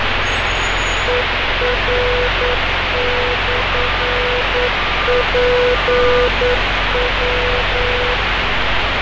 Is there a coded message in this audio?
Yes: Morse code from 1.0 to 8.2 s, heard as a keyed tone, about 9 wpm, 490 Hz, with heavy radio static, fading and street noise. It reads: ER/PW